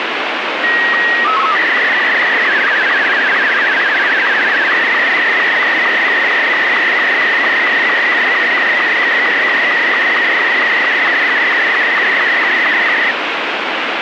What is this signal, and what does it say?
SSTV (slow-scan television), Martin M2, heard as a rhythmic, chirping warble, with heavy radio static.